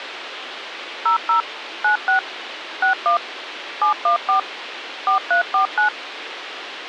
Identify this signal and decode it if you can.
DTMF, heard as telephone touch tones, dialled by machine, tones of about 110 ms, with radio hiss. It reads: 00 96 61 714 4349